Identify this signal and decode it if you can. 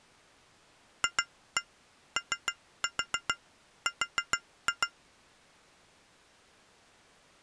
Tap code, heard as taps on glass, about 6 knocks a second. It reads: FOR